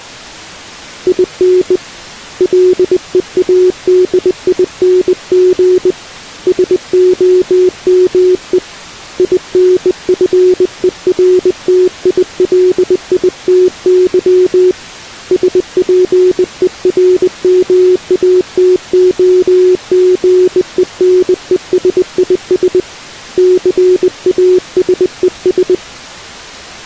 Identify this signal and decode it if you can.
Morse code, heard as a keyed tone, hand-sent with a bug key, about 20 wpm, 370 Hz. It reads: IN LEADING SOME INFERTILITY SPERMATOGENESIS CASES